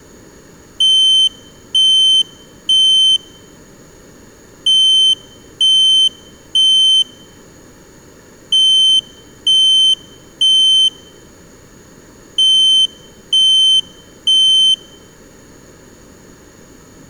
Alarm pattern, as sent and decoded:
3 beeps and a pause
temporal three

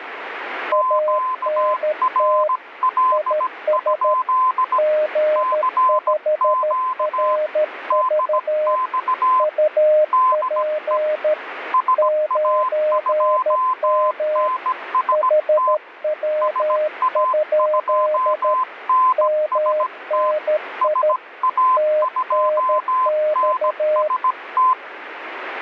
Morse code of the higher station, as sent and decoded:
--.- .-. .-.. ..--.. / -.-. --.- / -.. -..- / -.. . / ... .- ..--- -. ... - / ... .- ..--- -. ... - / ... .- ..--- -. ... -
QRL? CQ DX DE SA2NST SA2NST SA2NST

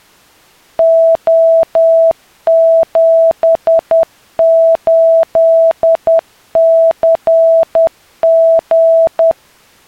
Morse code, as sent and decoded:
--- --... ---.. -.-. --.
O78CG

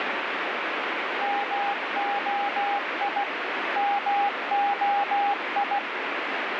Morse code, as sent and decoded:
-- --- .. / -- --- ..
MOI MOI

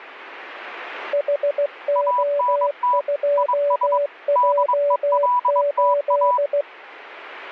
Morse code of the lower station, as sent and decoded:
.... --- ..--- .--- ---..
HO2J8

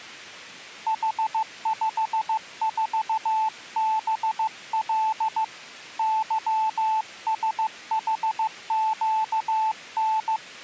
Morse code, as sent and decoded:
.... ..... ....- -... .-.. / -.-- ... .... --.- -.
H54BL YSHQN

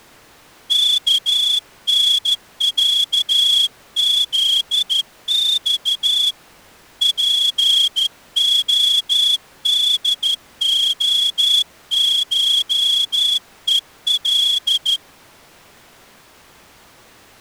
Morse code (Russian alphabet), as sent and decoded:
-.- -. .-.- --.. -..- / .--. --- -.. --- ---- . .-..
КНЯЗЬ ПОДОШЕЛ

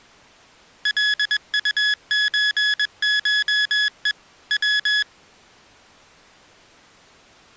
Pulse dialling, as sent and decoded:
none

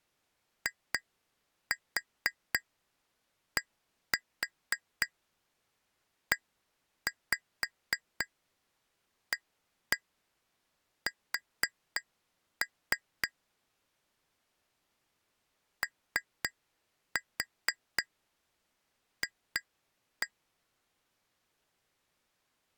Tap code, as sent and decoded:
2-4 1-4 1-5 1-1 4-3 / 3-4 2-1
IDEAS OF

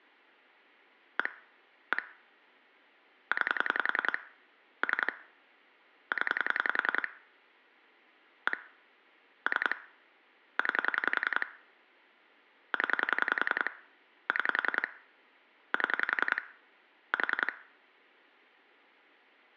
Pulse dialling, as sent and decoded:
1 / 1 / 9 / 3 / 10 / 1 / 3 / 9 / 10 / 6 / 7 / 4
1 1 9 3 0 1 3 9 0 6 7 4

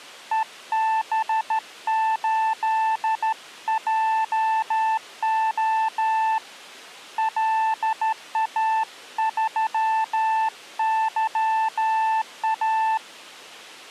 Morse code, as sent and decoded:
. -... ---.. .--- --- / .-.. .- ...-- -.-- .-
EB8JO LA3YA

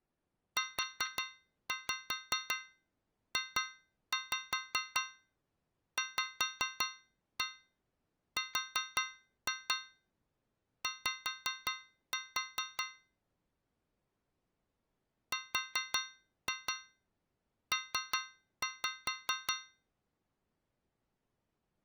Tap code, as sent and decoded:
4-5 2-5 5-1 4-2 5-4 / 4-2 3-5
UJVRY RP

